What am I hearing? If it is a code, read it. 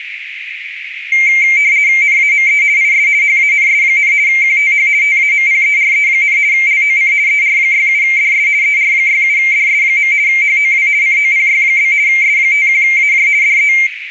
RTTY (50 baud, 170 Hz shift), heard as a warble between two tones, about 2200 Hz centre, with radio static and a narrow filter. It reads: NAME IS HANS, QTH TAMPERE, LOC ER67DS ER67DS. HOW COPY? S51AJ DE